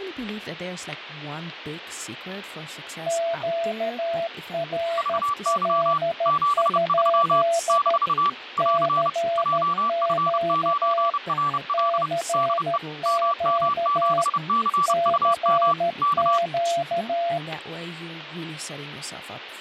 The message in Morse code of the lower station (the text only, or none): QRL? CQ CQ CQ